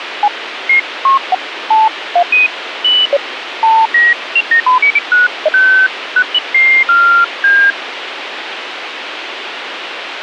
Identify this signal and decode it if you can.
Electronic bleeps of random pitch and length, with radio hiss. There is no code.